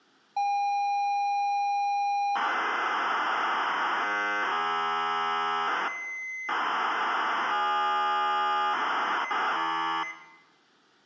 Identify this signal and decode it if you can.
ZX Spectrum tape loading, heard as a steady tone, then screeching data, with room echo.